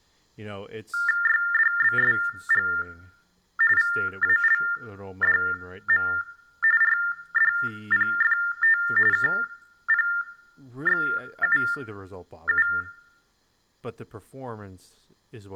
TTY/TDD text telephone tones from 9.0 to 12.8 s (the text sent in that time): KPXUU